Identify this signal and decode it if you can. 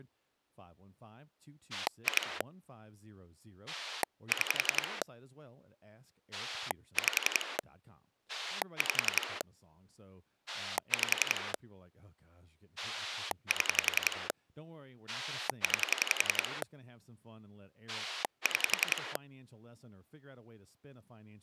Pulse dialling, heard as a rotary dial, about 11 pulses a second, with speech in English. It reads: 2 6 5 5 5 7 9 6